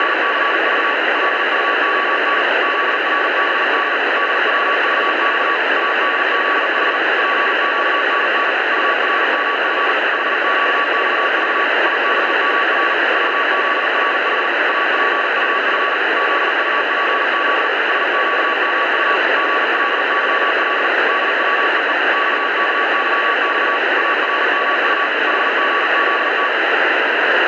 Morse code, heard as a keyed tone, machine-sent, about 39 wpm, 1140 Hz, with heavy radio static. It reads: … LUON ZRBD DWVX ADZH PQNN URMF HQXV IBMR VZRH APUF ZUPZ SQMU GLYL DWEE XKYX ARMU HGZT